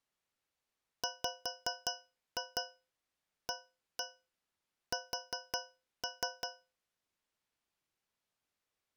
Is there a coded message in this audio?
Yes: tap code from 1.0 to 6.8 s, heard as taps on a metal pipe, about 5 knocks a second. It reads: WAS